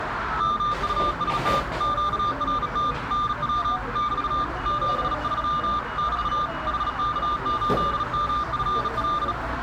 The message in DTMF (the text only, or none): none